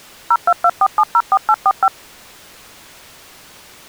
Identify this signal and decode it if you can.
DTMF, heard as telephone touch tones, dialled by machine, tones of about 50 ms. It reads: 0224704845